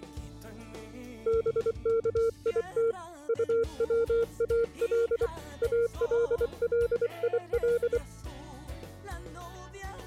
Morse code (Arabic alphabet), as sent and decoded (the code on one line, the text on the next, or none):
-... -.- .. - / ..- .-- .- .-.. / .- .-.. .-.. .. .-..
بكيت طوال الليل